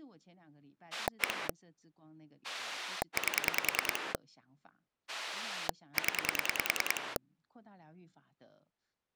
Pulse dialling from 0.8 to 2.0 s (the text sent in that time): 1